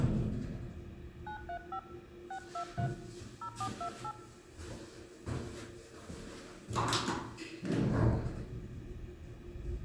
DTMF, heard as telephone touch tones, dialled by hand, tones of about 80 ms, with hum, room echo and the noise inside a lift. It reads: 935 623 0428